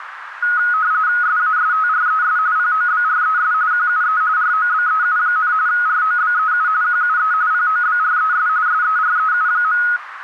RTTY (45.45 baud, 170 Hz shift), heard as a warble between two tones, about 1360 Hz centre, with radio static and a narrow filter. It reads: SASTRES POBRES QUE ROBEU, ROBEU QUE POBRES SEREU.